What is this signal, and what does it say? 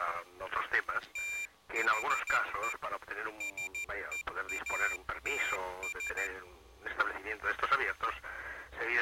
Morse code, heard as a high beeper, hand-sent with a paddle, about 14 wpm, 2400 Hz. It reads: THE SEATS